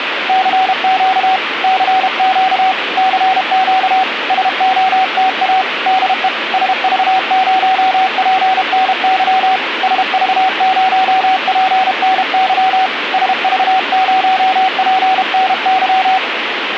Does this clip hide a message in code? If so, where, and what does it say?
Yes: Morse code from 0.2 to 16.2 s, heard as a keyed tone, hand-sent with a paddle, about 32 wpm, 760 Hz, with radio static. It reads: CQ CQ CQ SOTA DE SV0PNY SV0PNY SV0PNY